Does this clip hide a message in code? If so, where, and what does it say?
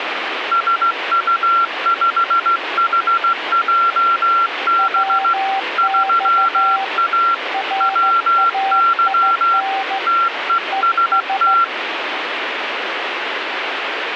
Yes: Morse code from 0.5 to 11.7 s, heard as two keyed tones, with radio static. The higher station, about 16 wpm, 1360 Hz: SU5HJB 3A WY TEST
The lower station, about 14 wpm, 780 Hz: WX RAIN ES